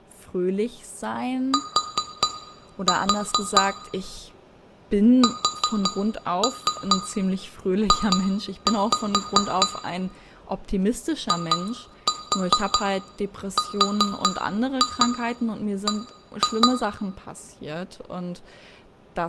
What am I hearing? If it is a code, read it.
Tap code, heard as taps on glass, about 4 knocks a second, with room echo and speech in German. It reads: T SJ IRB